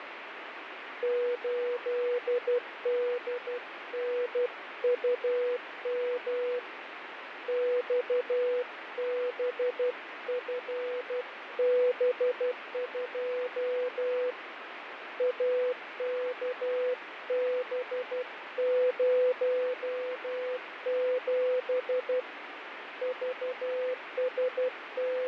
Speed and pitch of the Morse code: 12 wpm, 500 Hz

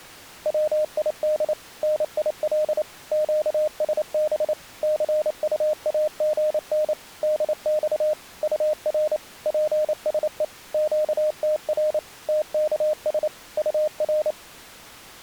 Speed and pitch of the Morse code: 28 wpm, 610 Hz

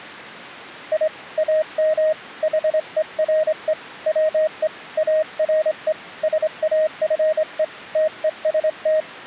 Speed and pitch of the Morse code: 25 wpm, 620 Hz

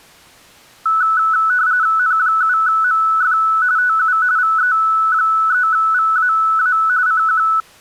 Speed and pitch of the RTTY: 45.45 baud, 170 Hz shift, 1400 Hz centre

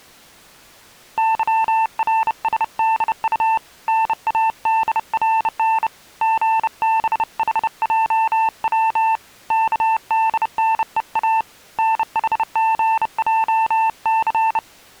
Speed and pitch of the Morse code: 30 wpm, 890 Hz

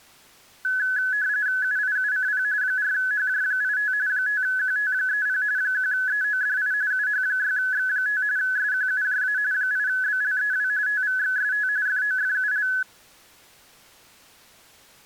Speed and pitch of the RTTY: 45.45 baud, 170 Hz shift, 1600 Hz centre

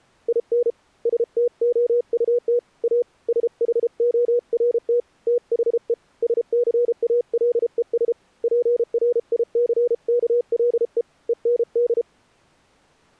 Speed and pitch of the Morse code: 33 wpm, 480 Hz

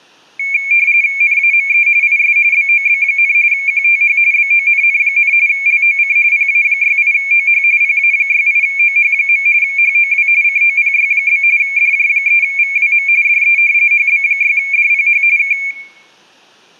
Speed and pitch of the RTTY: 45.45 baud, 170 Hz shift, 2300 Hz centre

